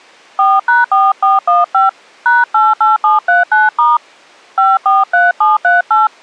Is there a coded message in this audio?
Yes: DTMF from 0.4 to 6.1 s, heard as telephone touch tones, dialled by hand, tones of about 170 ms. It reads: 4#4415 #88739* 543738